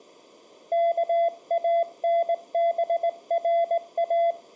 Morse code (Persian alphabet), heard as a keyed tone, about 19 wpm, 680 Hz. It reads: کانبرا